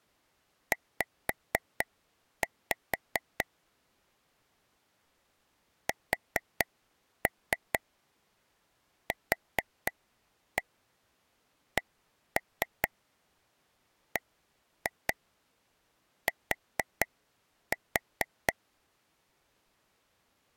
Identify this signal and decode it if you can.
Tap code, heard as taps on a table, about 4 knocks a second. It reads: Z SQCBT